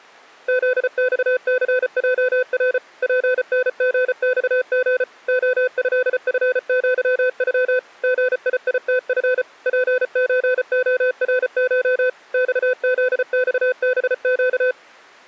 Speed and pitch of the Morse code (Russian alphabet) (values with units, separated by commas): 34 wpm, 510 Hz